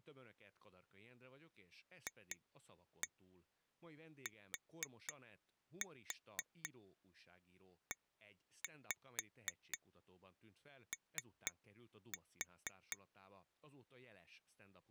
Tap code, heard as taps on glass, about 4 knocks a second, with speech in Hungarian. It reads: FTEO